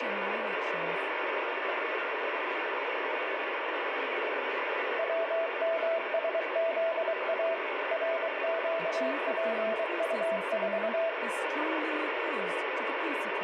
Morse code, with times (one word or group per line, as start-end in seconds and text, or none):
5.0-7.5 WMSZA
7.9-11.1 RQPU4